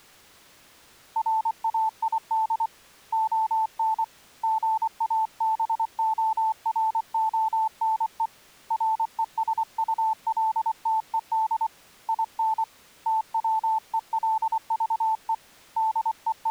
Morse code, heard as a keyed tone, hand-sent with a paddle, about 24 wpm, 880 Hz. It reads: RAID ON GABORONE RESULTED IN TWELVE …